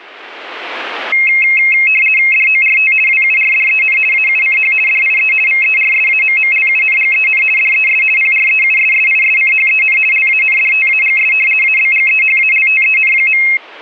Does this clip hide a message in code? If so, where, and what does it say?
Yes: RTTY (50 baud, 450 Hz shift) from 1.1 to 13.6 s, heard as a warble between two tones, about 2350 Hz centre. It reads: DORT WURDEN AUCH DIE VERSAMMLUNGEN DES PREUSSISCHEN LANDTAGS ABGEHALTEN.